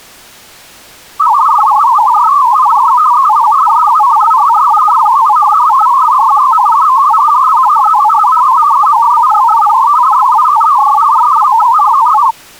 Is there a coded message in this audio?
Yes: multi-tone FSK (Olivia or MFSK type), about 500 Hz wide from 1.2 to 12.3 s, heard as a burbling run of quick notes, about 62.5 baud.